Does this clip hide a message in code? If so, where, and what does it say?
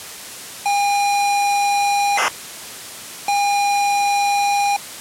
Yes: ZX Spectrum tape loading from 0.7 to 4.8 s, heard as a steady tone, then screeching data.